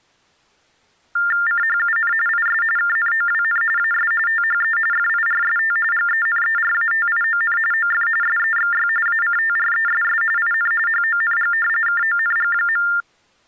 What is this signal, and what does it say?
TTY/TDD text telephone tones (45.45 baud Baudot), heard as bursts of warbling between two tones, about 400 Hz shift, 1600 Hz centre. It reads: CHUN IS KNOWN AS THE FIRST GENERATION OF SEXY ACTRESS IN HONG KONG.